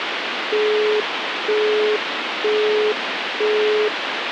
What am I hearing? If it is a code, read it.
Telephone call progress tone (single-tone plan, as in Europe, Japan and elsewhere), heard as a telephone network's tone, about 420 Hz, 0.48 s on and 0.48 s off, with phone line noise. Busy tone.